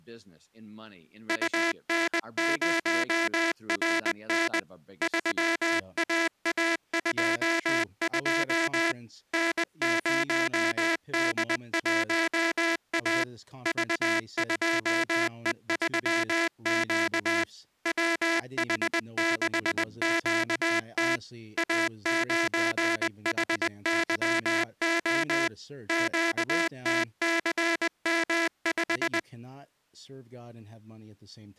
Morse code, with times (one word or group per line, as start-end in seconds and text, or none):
1.3-4.6 UN0RN
5.0-8.9 3AA22
9.3-13.2 N0D1A
13.7-17.4 V2E3Q
17.9-21.2 WH6QT
21.6-25.5 A9HYO
25.9-29.2 QTCM5